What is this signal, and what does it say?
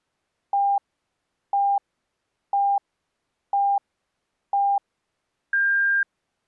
Radio time signal (five pips and a higher one, as on Chinese radio), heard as pips.